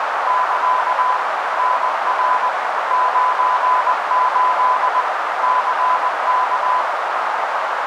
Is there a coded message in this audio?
Yes: Morse code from 0.2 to 6.9 s, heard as a keyed tone, machine-sent, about 20 wpm, 1010 Hz, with heavy radio static and a narrow filter. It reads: <KA> NR 98 CK